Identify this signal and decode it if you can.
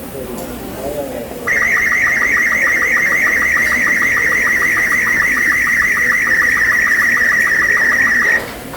SSTV (slow-scan television), Robot 36, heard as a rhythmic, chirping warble, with room echo and the noise of a restaurant.